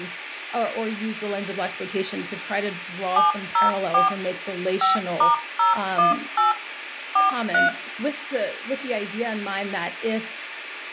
DTMF, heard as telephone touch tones, dialled by machine, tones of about 140 ms, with room echo and speech in English. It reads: 704 5*018 43